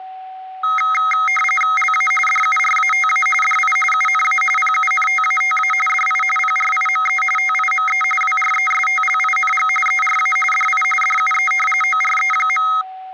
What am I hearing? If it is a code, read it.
RTTY (45.45 baud, 850 Hz shift), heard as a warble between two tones, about 1700 Hz centre, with a steady whistle near 750 Hz. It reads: LA DURATA DI UNA PUNTATA DI PRIME TIME WRESTLING ERA DI DUE ORE.